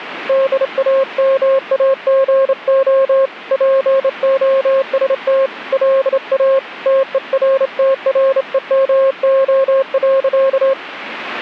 Morse code, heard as a keyed tone, hand-sent with a straight key, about 28 wpm, 540 Hz, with radio static. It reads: DAMAGO POST LA TERTREMO.